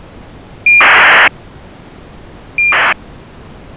ACARS aircraft data, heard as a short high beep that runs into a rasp, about 2400 baud.